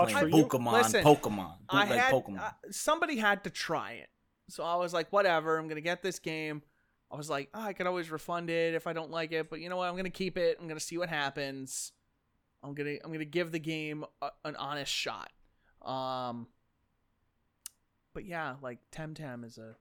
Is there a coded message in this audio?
No, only speech in English.